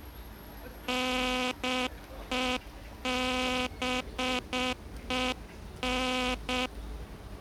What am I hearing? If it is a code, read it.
Morse code, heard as a buzzer, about 7 wpm, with the noise of a park. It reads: NEBEN